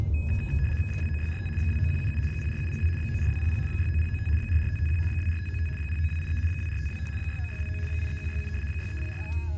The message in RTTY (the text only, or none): 29645 29177 04702 94200 69095 44551 24595 09283 24525 69629 83167 63041